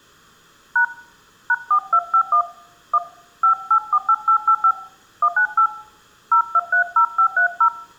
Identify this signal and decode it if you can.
DTMF, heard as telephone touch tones, dialled by hand, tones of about 80 ms. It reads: # #4251 1 5848885 198 0230530